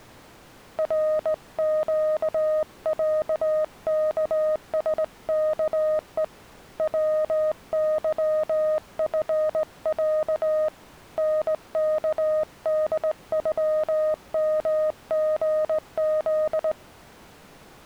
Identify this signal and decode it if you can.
Morse code (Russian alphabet), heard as a keyed tone, hand-sent with a straight key, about 19 wpm, 620 Hz. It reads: РЩЯКСКЕ ВЫФЯ НКДЮМГЗ